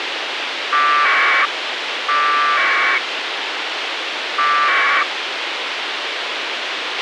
Packet radio (AX.25, as in APRS), 1200 baud, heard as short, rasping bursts, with radio hiss and a squelch burst at the end.